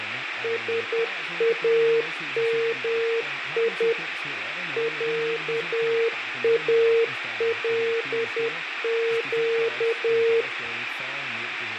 Morse code (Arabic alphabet), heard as a keyed tone, machine-sent, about 10 wpm, 460 Hz, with radio static, fading and speech in Danish. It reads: سامي عالق